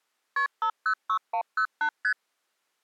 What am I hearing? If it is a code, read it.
Multi-frequency trunk signalling (R1, as on North American trunks), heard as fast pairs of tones, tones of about 80 ms. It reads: KP 506108 ST